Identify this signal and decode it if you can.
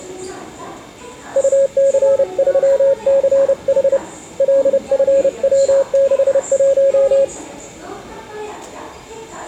Morse code, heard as a keyed tone, hand-sent with a paddle, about 30 wpm, 550 Hz, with the noise of a subway station. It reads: UC3CH LFW61